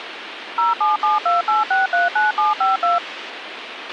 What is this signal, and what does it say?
DTMF, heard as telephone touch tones, dialled by machine, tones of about 160 ms, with radio hiss and a squelch burst at the end. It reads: 07728639752